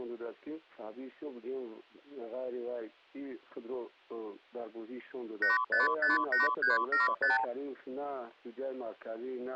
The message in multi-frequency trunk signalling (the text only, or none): 8558375